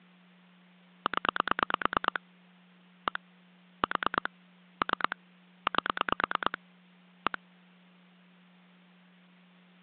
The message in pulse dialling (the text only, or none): 0 1 4 3 8 1